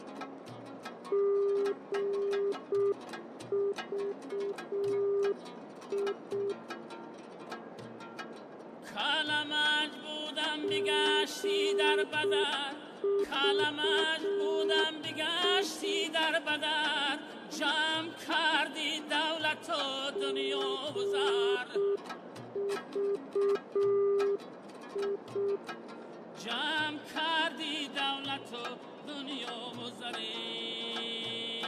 Morse code, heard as a keyed tone, machine-sent, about 6 wpm, 400 Hz, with radio static, fading and a narrow filter. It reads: GVI GVI GVI